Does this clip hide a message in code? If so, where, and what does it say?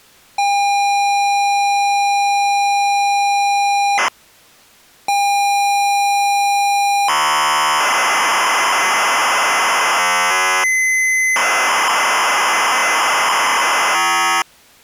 Yes: ZX Spectrum tape loading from 0.4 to 14.4 s, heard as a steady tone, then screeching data.